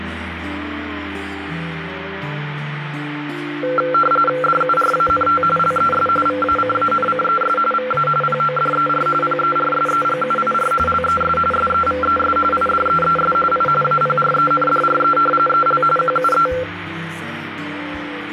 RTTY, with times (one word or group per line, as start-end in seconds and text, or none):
4.4-5.4 DURANT
5.6-6.1 LES
6.3-7.6 VACANCES
7.7-8.1 VA
8.2-9.1 PODER
9.2-10.7 PERSEGUIR
10.9-11.4 LES
11.5-12.4 SEVES
12.5-13.3 IDEES
13.5-13.7 I
13.8-15.2 APRENDRE
15.5-15.8 EL
16.0-16.5 QUE